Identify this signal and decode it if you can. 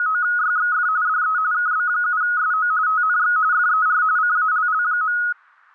RTTY (45.45 baud, 170 Hz shift), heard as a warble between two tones, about 1360 Hz centre, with static crashes. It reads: … DE KB7SO TNX FER CALL.